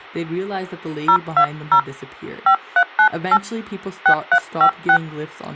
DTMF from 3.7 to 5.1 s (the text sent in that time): 6356